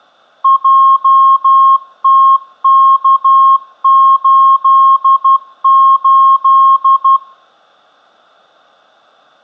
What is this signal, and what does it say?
Morse code, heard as a keyed tone, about 12 wpm, 1080 Hz. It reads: JTK88